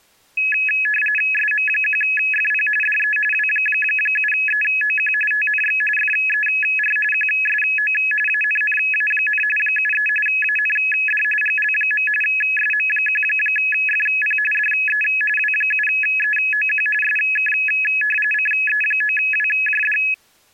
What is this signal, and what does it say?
RTTY (45.45 baud, 850 Hz shift), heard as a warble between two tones, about 2150 Hz centre. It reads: SM1FP DE W7EOQ TNX FER QSO ANNA, 73 AND GL. SM1FP DE W7EOQ SK CE9WJD